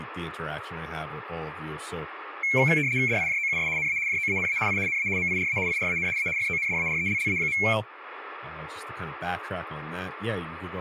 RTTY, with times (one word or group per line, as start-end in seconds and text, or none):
3.1-3.7 DIJOUS
3.8-4.0 NA
4.1-4.6 JOANA
4.7-4.8 I
4.9-5.1 NA
5.2-5.6 MIRA
5.7-6.1 IRAN
6.2-6.3 A
6.4-7.6 FONDARELLA.